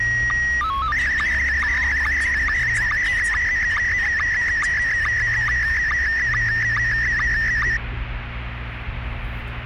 SSTV (slow-scan television), Scottie S1, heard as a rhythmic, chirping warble, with radio static and the noise inside a car.